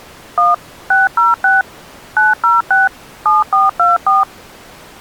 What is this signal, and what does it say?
DTMF, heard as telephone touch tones, dialled by machine, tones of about 170 ms. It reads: 1 606 906 7424